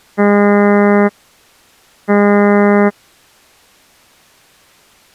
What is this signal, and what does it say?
Ship horn signal, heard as a ship's horn, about 200 Hz. 2 short. At sea: I am altering course to port.